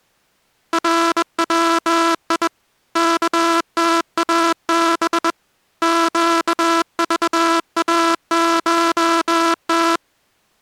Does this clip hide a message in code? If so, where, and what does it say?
Yes: Morse code (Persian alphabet) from 0.7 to 10.0 s, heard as a buzzer, hand-sent with a bug key, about 21 wpm. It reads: روی کتاب گذاشت